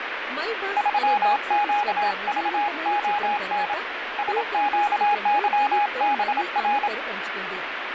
Morse code, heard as a keyed tone, hand-sent with a paddle, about 27 wpm, 830 Hz, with radio static and speech in Telugu. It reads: 3QVON SQYBR